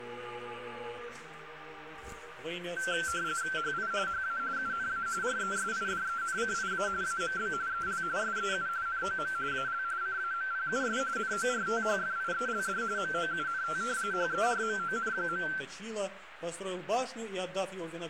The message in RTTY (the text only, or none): HI HA UNA RESIDENCIA AMB EL SEU NOM AL CAMPUS NORTHFIELD MOUNT HERMON.